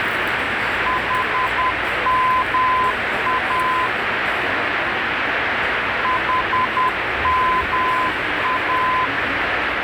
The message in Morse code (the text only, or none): HMA HMA